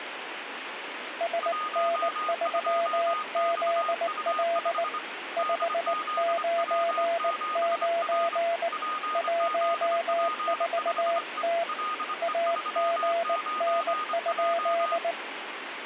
Morse code, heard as two keyed tones, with radio static. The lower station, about 19 wpm, 680 Hz: SN3ZL 599 14T AGN?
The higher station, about 25 wpm, 1230 Hz: 12XU5 DZW7R PZP5E LE39J